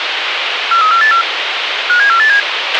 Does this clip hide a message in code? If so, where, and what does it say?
Yes: five-tone selective call (CCIR) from 0.7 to 2.4 s, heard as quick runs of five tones, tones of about 100 ms, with radio hiss and a squelch burst at the end. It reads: 43484 57487